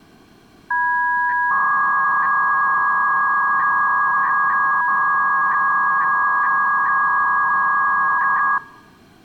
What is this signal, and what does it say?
300-baud modem data (V.21 tones), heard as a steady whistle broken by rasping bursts, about 300 baud, 200 Hz shift.